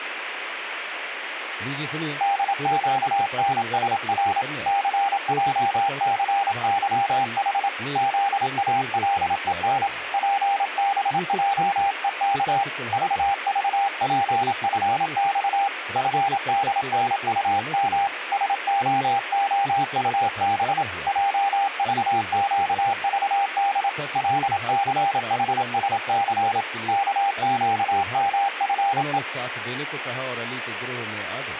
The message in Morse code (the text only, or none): DQNSR CJCYH ZALEN PBJEK VVPFX FDNUM SOOUB JVQVD LCHSC KQMFE